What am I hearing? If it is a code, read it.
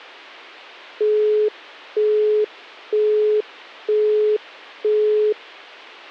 Telephone call progress tone (single-tone plan, as in Europe, Japan and elsewhere), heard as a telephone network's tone, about 420 Hz, 0.48 s on and 0.48 s off. Busy tone.